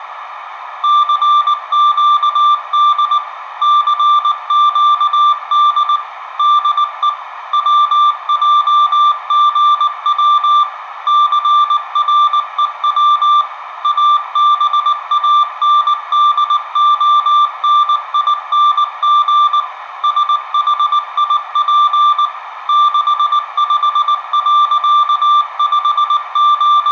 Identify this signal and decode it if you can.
Morse code, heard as a keyed tone, machine-sent, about 19 wpm, 1180 Hz, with radio static and a narrow filter. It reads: CQD CQD DE WJGW CREW ABANDONING SHIP …